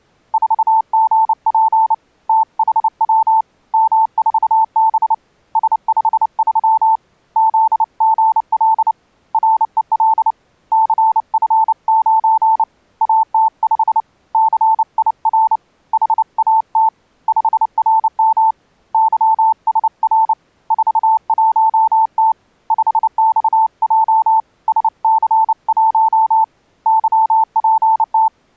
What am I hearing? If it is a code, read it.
Morse code, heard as a keyed tone, hand-sent with a paddle, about 29 wpm, 890 Hz. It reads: 4GP THW M4B S53 ZGL REL CF9 AT5 CIR HAT 5RM YSR 41T 5XJ SC1 YPT